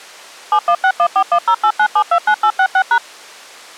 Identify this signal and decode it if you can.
DTMF, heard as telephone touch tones, dialled by machine, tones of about 70 ms. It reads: 716141089729866#